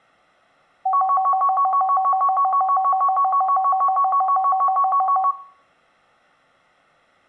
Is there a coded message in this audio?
No, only a tone that alternates evenly between two pitches, with room echo.